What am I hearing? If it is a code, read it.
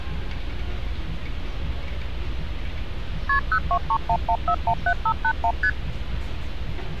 Multi-frequency trunk signalling (R1, as on North American trunks), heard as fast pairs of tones, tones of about 70 ms, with street noise. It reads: KP 02311417581 ST